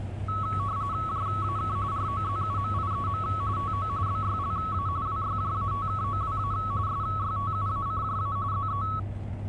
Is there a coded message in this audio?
Yes: RTTY (45.45 baud, 170 Hz shift) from 0.3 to 9.0 s, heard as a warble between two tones, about 1210 Hz centre, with the noise inside a bus. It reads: JAK ROZUMIEM TO BYLA WYJATKOWA SYTUACJA ZE